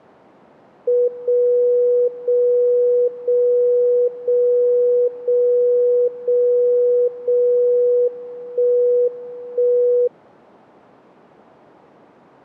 Radio time signal (WWVB), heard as a tone whose level steps once a second, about 490 Hz. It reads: 0 0 0 0 0 0 0 1 1